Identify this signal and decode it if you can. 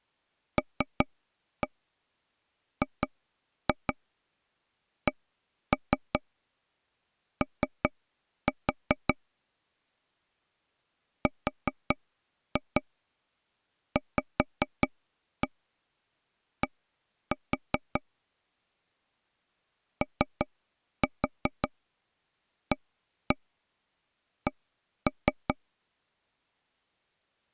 Tap code, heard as taps on a table, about 5 knocks a second. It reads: LGCO RVD OAC